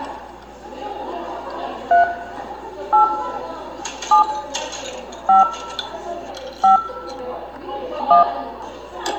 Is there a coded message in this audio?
Yes: DTMF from 1.9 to 8.2 s, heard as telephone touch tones, dialled by hand, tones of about 130 ms, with room echo and the noise of a cafe. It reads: 3 8 7 5 5 1